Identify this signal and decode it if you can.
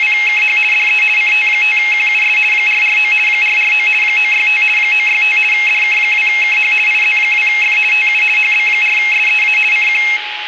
RTTY (50 baud, 450 Hz shift), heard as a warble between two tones, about 2350 Hz centre, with radio static, a steady whistle near 840 Hz and room echo. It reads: … DE CT5QUS 449 449 965 965 DK2KH IZ2F TU HB4SEA CQ